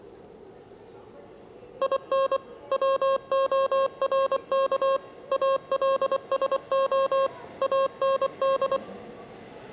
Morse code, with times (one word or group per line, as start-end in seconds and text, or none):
1.8-2.4 IN
2.7-5.0 WORK
5.3-7.3 ALSO
7.6-8.8 AND